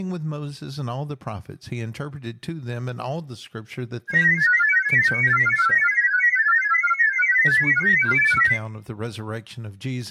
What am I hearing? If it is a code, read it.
Multi-tone FSK (Olivia or MFSK type), about 1000 Hz wide, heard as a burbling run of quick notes, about 31.25 baud, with speech in English.